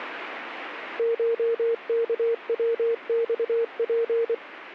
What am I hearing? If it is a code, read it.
Morse code (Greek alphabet), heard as a keyed tone, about 24 wpm, 460 Hz. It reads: ΧΚΩΞΠ